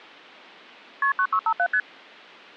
Multi-frequency trunk signalling (R1, as on North American trunks), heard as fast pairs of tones, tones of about 70 ms. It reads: KP 9657 ST